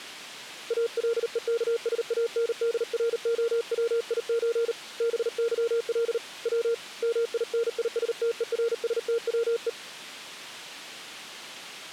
Morse code (Russian alphabet), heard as a keyed tone, hand-sent with a paddle, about 38 wpm, 460 Hz. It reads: АЛЕКСАНДРОВИЧ БЫЛ В МИНИСТЕРСТВЕ